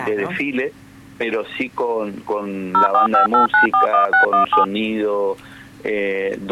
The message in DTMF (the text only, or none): 0458941617